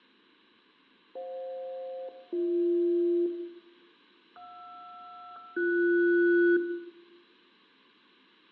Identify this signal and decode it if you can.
Aircraft SELCAL, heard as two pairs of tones, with room echo. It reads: FJ-BH JR-BS